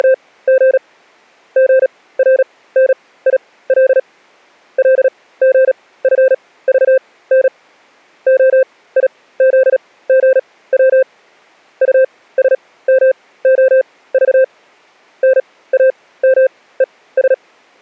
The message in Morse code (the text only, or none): … GRNIL LGFVN OIZGW USMOV NAMES